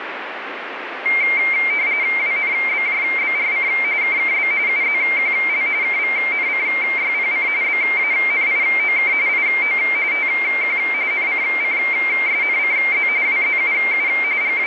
RTTY (45.45 baud, 170 Hz shift), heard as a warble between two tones, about 2200 Hz centre, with radio static. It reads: WNBJBRC KKB UZQL KVNCYPC BANIOK IO TQ NCCSNCZ WZUU …